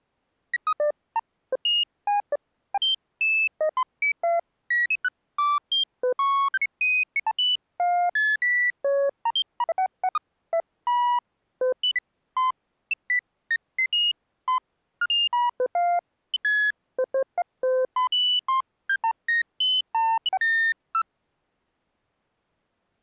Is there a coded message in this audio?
No, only electronic bleeps of random pitch and length.